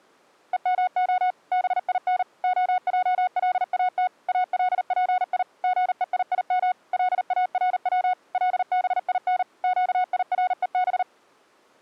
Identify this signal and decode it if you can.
Morse code (Hebrew alphabet), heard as a keyed tone, machine-sent, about 39 wpm, 730 Hz. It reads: ומה בין העלאת אלפי גויים לארץ לבין קירוב